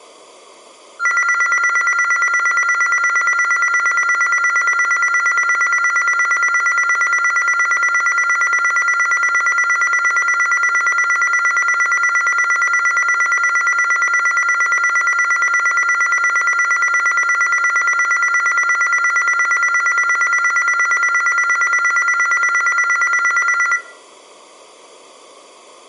A tone that alternates evenly between two pitches, with room echo. There is no code.